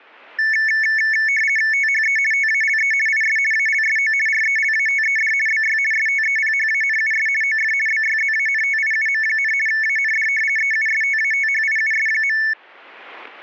RTTY (50 baud, 450 Hz shift), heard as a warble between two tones, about 2000 Hz centre, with static crashes. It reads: THE TALE IS ALSO RELATED BY STEPHANUS OF BYZANTIUM, AND EUSTATHIUS.